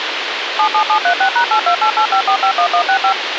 DTMF, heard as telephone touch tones, dialled by machine, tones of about 90 ms, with radio hiss. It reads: 77736#82885451165